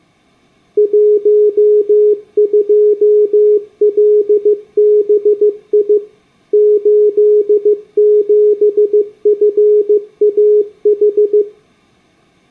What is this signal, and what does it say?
Morse code, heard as a keyed tone, machine-sent, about 15 wpm, 420 Hz. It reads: 12LBI 87FAH